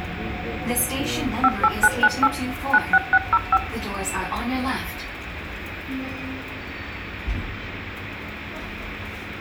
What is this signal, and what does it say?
DTMF, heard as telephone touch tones, dialled by machine, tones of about 50 ms, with room echo and the noise inside a subway train. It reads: 58998 96605